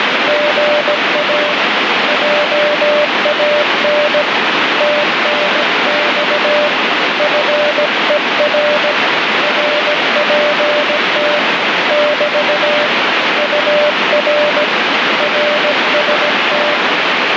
Morse code, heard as a keyed tone, hand-sent with a paddle, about 17 wpm, 590 Hz, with heavy radio static. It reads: GA JAN TNX FER RPT <BT> UR RST